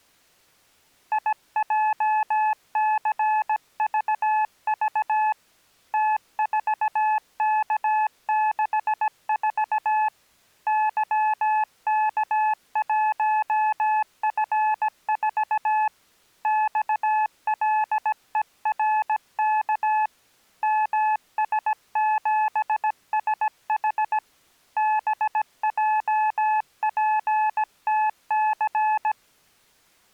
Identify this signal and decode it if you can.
Morse code, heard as a keyed tone, hand-sent with a paddle, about 17 wpm, 860 Hz. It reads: IJCVV T4K64 YK1F4 XLERK MS7SH BJPTC